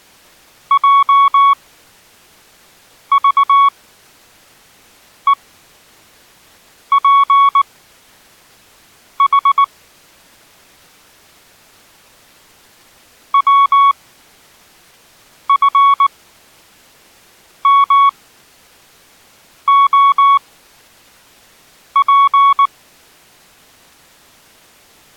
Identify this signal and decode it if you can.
Morse code, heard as a keyed tone, machine-sent, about 19 wpm, spaced as for 5 wpm, 1120 Hz. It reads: JVEPH WFMOP